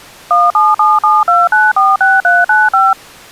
DTMF, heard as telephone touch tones, dialled by machine, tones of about 200 ms. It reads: 17772946395